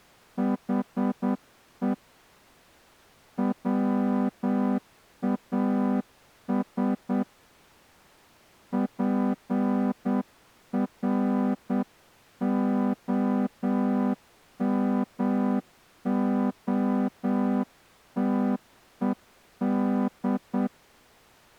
Morse code, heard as a horn, hand-sent with a straight key, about 8 wpm. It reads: HE WAS PROMOTED